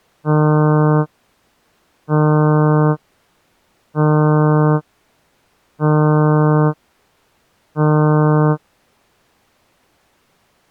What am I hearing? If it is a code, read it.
Ship horn signal, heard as a ship's horn, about 150 Hz. 5 short. At sea: I doubt that you are doing enough to avoid a collision.